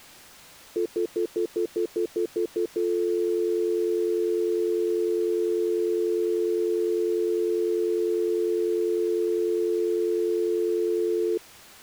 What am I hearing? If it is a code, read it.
Telephone call progress tone (North American plan), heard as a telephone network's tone, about 350, 440 Hz, 0.1 s on and 0.1 s off. Stutter dial tone.